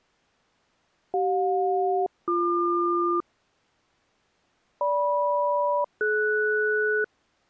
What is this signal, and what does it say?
Aircraft SELCAL, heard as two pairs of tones. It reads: CJ-BQ GM-DS